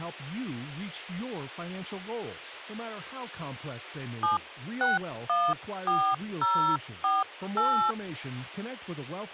DTMF, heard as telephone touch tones, dialled by hand, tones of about 250 ms, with speech in English. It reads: 7614048